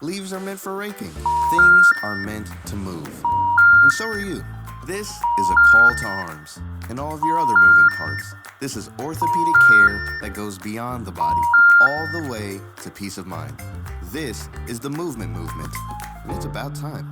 Telephone call progress tone (ITU plan), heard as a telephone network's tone, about 950, 1400, 1800 Hz. Special information tone.